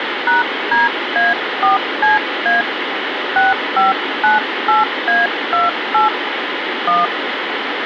DTMF, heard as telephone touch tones, dialled by hand, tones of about 150 ms, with radio hiss and room echo. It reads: #DA4CA 6598A28 1